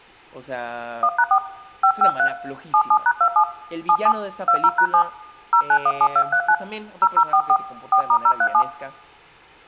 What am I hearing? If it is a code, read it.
DTMF, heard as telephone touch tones, dialled by hand, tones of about 70 ms, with speech in Spanish. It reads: 1#4 553 77#27 77 20#7 0917239 0044 4*037